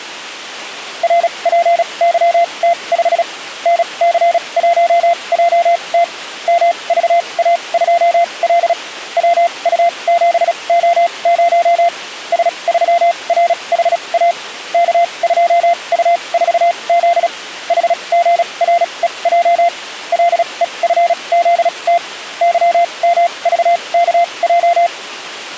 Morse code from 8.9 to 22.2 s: WU7O0 S3RHA K2U4Z HGREJ LEFZT

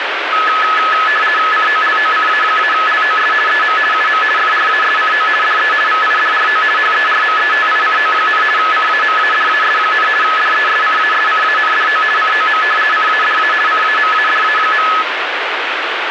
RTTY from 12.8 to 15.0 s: CADA CAMADA.

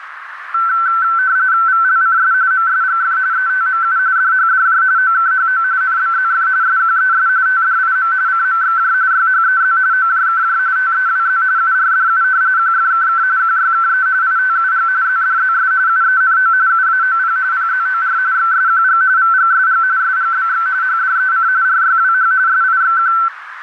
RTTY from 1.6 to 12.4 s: VLCS MSGF ETMU DHDJ OKHO NBZF SQES TDIM CMXJ YHEZ OJKJ TEWZ URDU

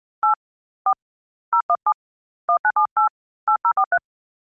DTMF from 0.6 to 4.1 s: 4 017 1978 8043

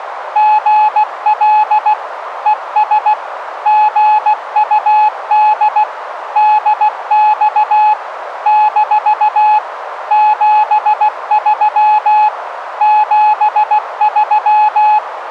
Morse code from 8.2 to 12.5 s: - 73

